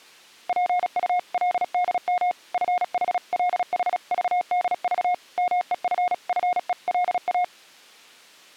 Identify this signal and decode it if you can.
Morse code (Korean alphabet), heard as a keyed tone, machine-sent, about 36 wpm, 720 Hz. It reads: 지금 누구를 만나고